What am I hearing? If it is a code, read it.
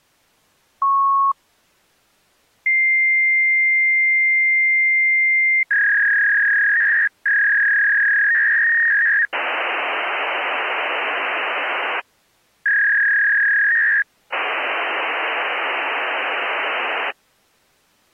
Fax machine handshake, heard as a beep, a long tone, a warble and hiss.